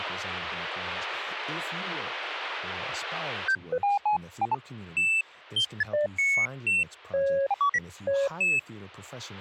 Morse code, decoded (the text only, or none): none